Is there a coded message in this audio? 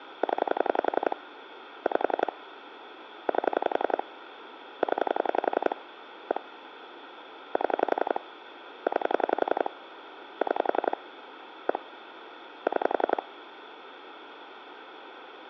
Yes: pulse dialling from 0.2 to 13.2 s, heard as clicks on a phone line, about 11 pulses a second, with phone line noise. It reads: 0 5 8 0 1 7 9 6 1 6